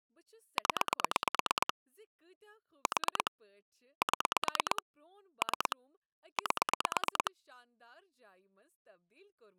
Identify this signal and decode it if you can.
Pulse dialling, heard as clicks on a phone line, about 9 pulses a second, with speech in Kashmiri. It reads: 0 4 7 3 8